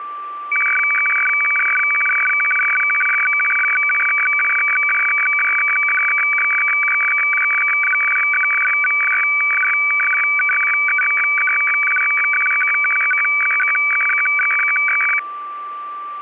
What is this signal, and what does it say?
Weather fax (radiofax), 120 lines a minute, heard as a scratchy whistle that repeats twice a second, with a steady whistle near 1170 Hz.